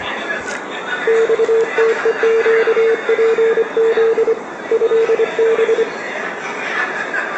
Morse code (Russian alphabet), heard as a keyed tone, hand-sent with a straight key, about 25 wpm, 450 Hz, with radio static, a narrow filter, room echo and the noise of a crowd indoors. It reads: ЬТЕЩПЗ ЭБ